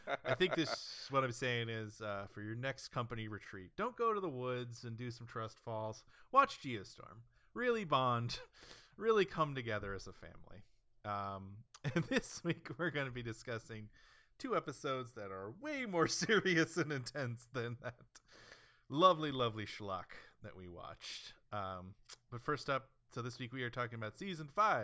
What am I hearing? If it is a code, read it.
Speech in English. There is no code.